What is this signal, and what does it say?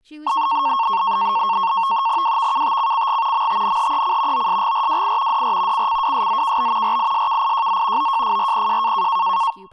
NAVTEX (SITOR-B), 100 baud, 170 Hz shift, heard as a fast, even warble, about 1000 Hz centre, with speech in English. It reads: WVKTCCG MTNHEC OSGRWI DR CCWSZKB RISKIJZ OJFRPJ